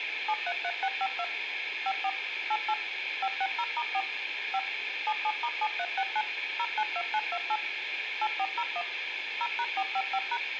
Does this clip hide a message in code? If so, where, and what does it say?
Yes: DTMF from 0.3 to 10.4 s, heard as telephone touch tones, dialled by machine, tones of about 60 ms, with phone line noise. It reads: 733652 54 88 560*4 5 77*7369 092928 8401 0#455#